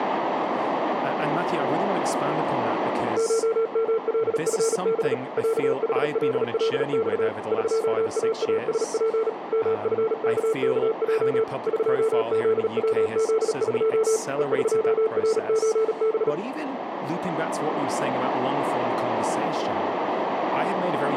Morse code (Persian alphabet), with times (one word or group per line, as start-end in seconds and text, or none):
3.2-5.1 شملفب
5.4-7.3 صحللخ
7.5-9.3 قااسپ
9.5-11.4 مفککج
11.7-14.2 قزوزق
14.4-16.3 هقرچب